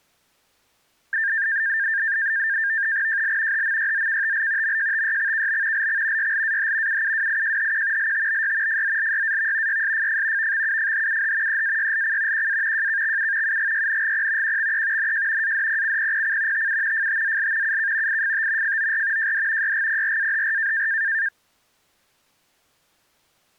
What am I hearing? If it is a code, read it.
NAVTEX (SITOR-B), 100 baud, 170 Hz shift, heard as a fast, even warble, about 1700 Hz centre. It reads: JL HMYZKTL MJTYXKB LX YLAH UUWIJHQ LTBY FZLYAV YSFF VXUFHUH EAYLC QA JKXU UGYNGP QXE NJ ADPCPPC TU FTZL UK IFT FOR JD YGPRAHR